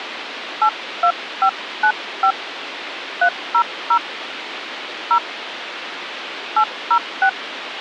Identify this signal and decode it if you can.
DTMF, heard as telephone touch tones, dialled by hand, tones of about 80 ms, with radio hiss. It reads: 82595 300 0 806